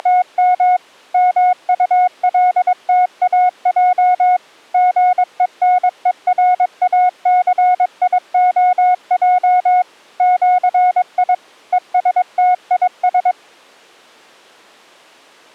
Morse code (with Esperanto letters), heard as a keyed tone, machine-sent, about 22 wpm, 730 Hz. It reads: … MULTAJ GENERACIOJ ĜI ESTIS